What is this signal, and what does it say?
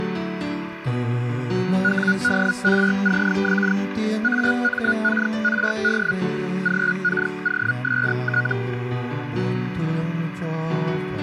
Hellschreiber (Feld-Hell, 122.5 baud), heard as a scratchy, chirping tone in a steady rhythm, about 1450 Hz, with radio static. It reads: WDRCX AMKRD GKOST